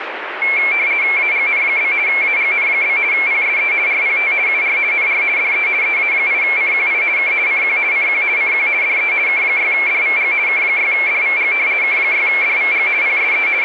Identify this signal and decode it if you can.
RTTY (50 baud, 170 Hz shift), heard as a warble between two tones, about 2250 Hz centre, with radio static. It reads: AGN? AGN? PSE RPT UR NR DE EA8CQI K CQ CQ CQ DE K6DVG K6DVG K6DVG PSE …